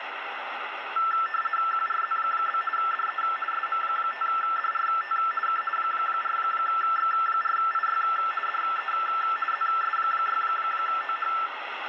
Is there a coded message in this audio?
Yes: RTTY (50 baud, 450 Hz shift) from 1.0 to 11.5 s, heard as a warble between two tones, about 1550 Hz centre, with radio static. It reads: QRZ? DE SM5DRT K 4X4IY DE ZS6OH